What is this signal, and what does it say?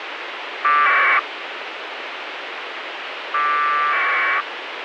Packet radio (AX.25, as in APRS), 1200 baud, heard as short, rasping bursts, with radio hiss.